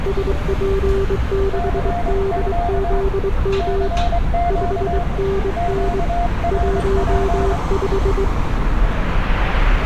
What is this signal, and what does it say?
Morse code, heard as two keyed tones, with street noise. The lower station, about 22 wpm, 390 Hz: SP6DZM 5NN 15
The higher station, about 23 wpm, 700 Hz: CQ CQ QRP